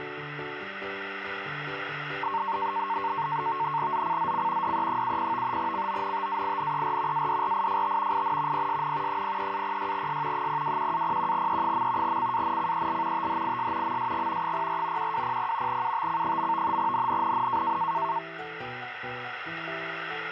NAVTEX (SITOR-B), 100 baud, 170 Hz shift, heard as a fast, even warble, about 1000 Hz centre, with radio static. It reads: ZCZC DE70 CONTAINER ADRIFT IN PSN 03-06S 021-01E. CANCEL THIS MSG 04 1200 UTC. NNNN